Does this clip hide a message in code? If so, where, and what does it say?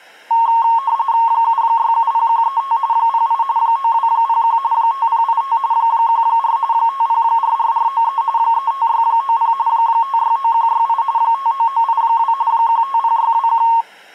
Yes: RTTY (45.45 baud, 170 Hz shift) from 0.3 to 13.8 s, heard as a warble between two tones, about 1000 Hz centre. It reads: 7670135 08 9201 5085 14 5044493 35690 569168 59982 150621